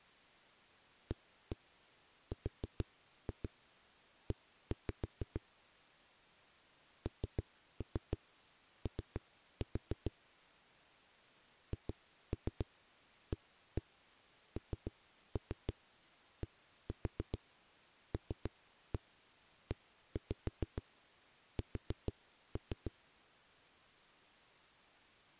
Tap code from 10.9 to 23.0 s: HANDLES

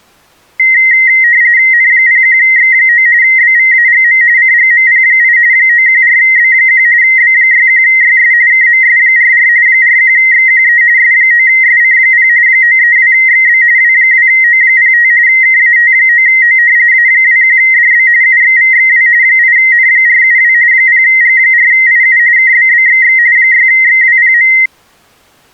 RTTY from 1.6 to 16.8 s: N01X9 BVAGM CGMP8 914B1 B61YS KMS44 41XQE S9SC0 932XB W2O05 KAT9O

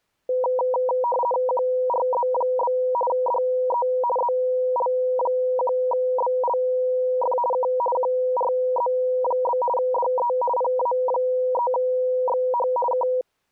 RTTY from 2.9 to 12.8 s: DE ZL1BLF K QRZ? DE PA3XH

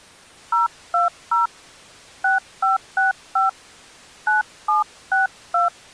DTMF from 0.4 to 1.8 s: 020

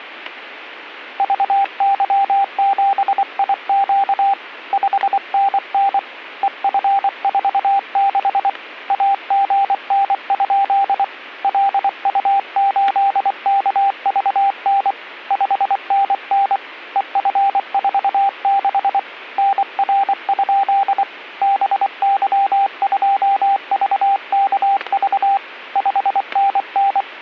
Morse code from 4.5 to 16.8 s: 5NN EF46 AGN? LU8KVN 5NN

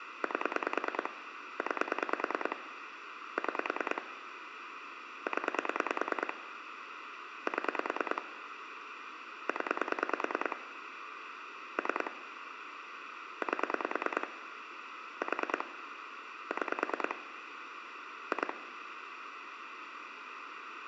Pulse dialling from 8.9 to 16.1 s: 0 3 8 4

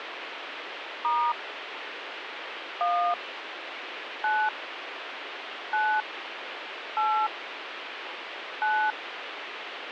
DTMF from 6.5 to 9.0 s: 8 9

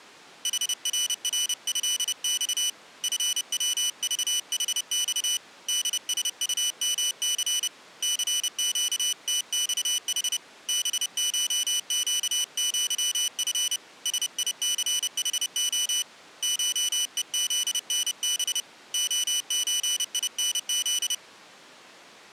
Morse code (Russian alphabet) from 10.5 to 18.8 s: БШЩЪФ СИЦХО ШЕЗНБ

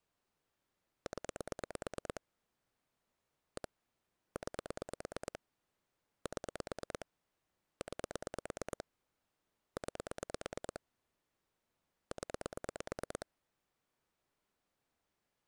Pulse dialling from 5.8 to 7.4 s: 7

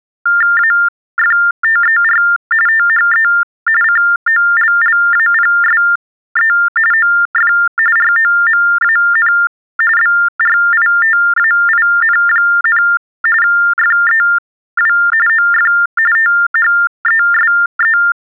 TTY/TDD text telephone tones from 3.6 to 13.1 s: COLLAPSE OF ROMAN BRITAIN,

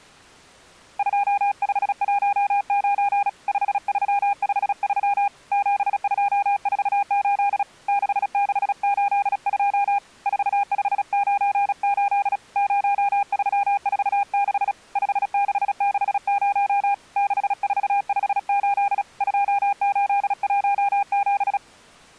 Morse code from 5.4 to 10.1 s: 7248 6682

